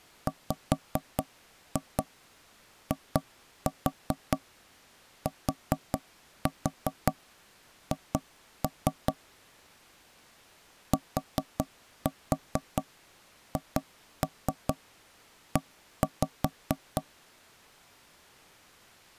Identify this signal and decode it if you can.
Tap code, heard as knocks on wood, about 4 knocks a second. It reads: WITH THE